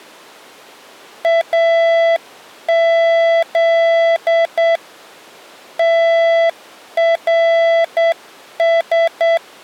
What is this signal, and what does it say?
Morse code (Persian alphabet), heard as a keyed tone, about 8 wpm, 670 Hz. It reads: از ترس